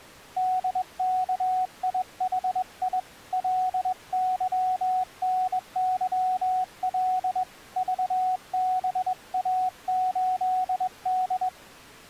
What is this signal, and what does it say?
Morse code, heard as a keyed tone, hand-sent with a straight key, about 21 wpm, 740 Hz. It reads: DKIHI LYNYL VBA8D